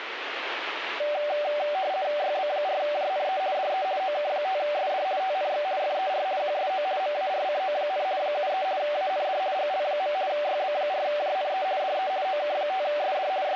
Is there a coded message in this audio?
Yes: RTTY (50 baud, 170 Hz shift) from 1.0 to 13.6 s, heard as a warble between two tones, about 680 Hz centre, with radio static. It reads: YB4JNE DE OK5SD TNX FER QSO MARCO, 73 AND GL. YB4JNE DE OK5SD …